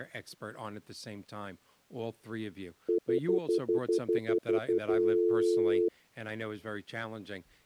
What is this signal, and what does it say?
Telephone call progress tone (North American plan), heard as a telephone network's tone, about 350, 440 Hz, 0.1 s on and 0.1 s off, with speech in English. Stutter dial tone.